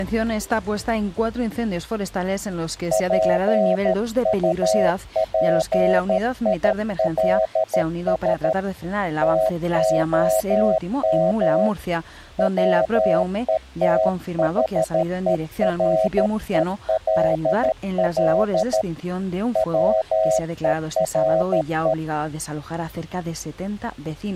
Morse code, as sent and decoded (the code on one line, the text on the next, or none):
.--. ..- .--. .. .-.. ... / - --- -- / .-- . - .... . .-. . .-.. .-.. / .-- . .-. .
PUPILS TOM WETHERELL WERE